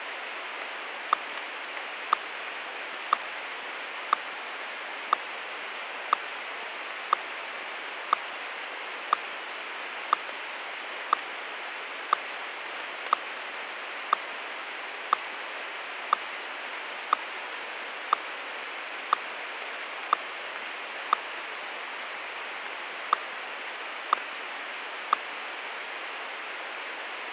Radio time signal (WWVH, Hawaii), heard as ticks, one a second, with radio static.